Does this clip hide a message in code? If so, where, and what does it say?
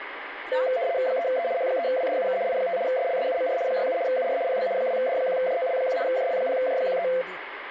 Yes: RTTY (75 baud, 170 Hz shift) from 0.5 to 7.2 s, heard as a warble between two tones, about 600 Hz centre, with radio static and speech in Telugu. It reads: 3E H3WDUK I5 SLSUMR 67 UR PB 2D1JOL1 JL0J13